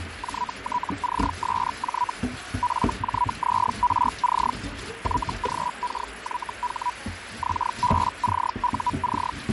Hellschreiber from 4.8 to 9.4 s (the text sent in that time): YGKYH XBCUC